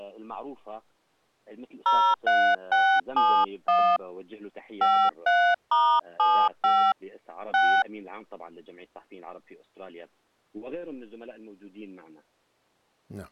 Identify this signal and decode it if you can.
DTMF, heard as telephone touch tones, dialled by hand, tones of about 280 ms. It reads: 03671 53*75 6